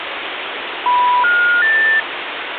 Telephone call progress tone (North American plan), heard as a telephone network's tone, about 980, 1430, 1800 Hz, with phone line noise. Special information tone.